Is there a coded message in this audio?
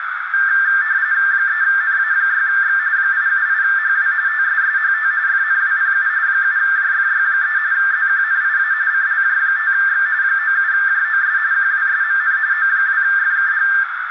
Yes: RTTY (45.45 baud, 170 Hz shift) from 0.3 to 13.8 s, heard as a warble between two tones, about 1700 Hz centre, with radio static and a narrow filter. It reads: 3NA6X 878HW TSSHT FNWPU 7JFY3 ZQNIA CLJ5X 97JOS QWSMN O2FKG